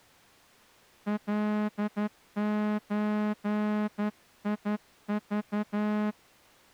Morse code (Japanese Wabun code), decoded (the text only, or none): カゾク